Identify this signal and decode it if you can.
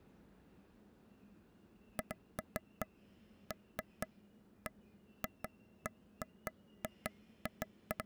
Irregular taps on a table, with the noise of a subway station. There is no code.